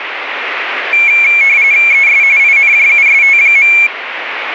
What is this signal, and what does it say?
RTTY (45.45 baud, 170 Hz shift), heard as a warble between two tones, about 2300 Hz centre, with radio static. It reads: ES INJUST.